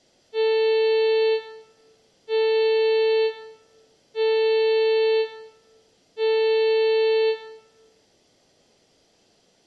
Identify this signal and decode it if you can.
Ship horn signal, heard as a ship's horn, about 440 Hz, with room echo. 4 short. At sea: a pilot vessel's identity signal in fog.